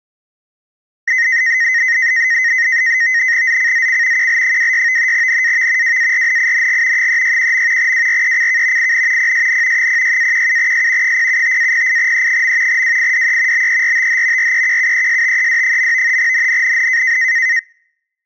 NAVTEX (SITOR-B), 100 baud, 170 Hz shift, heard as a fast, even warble, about 1950 Hz centre. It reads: ZCZC QL26 NAV WARNING 361. WRECK IN PSN 06-17S 075-08E. WIDE BERTH REQUESTED. NNNN